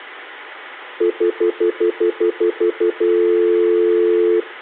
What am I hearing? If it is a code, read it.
Telephone call progress tone (North American plan), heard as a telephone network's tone, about 350, 440 Hz, 0.1 s on and 0.1 s off, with hum and room echo. Stutter dial tone.